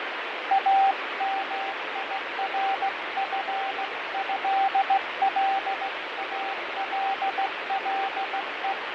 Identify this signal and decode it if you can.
Morse code (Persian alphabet), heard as a keyed tone, hand-sent with a straight key, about 16 wpm, 780 Hz, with heavy radio static and fading. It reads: امیرفضلالله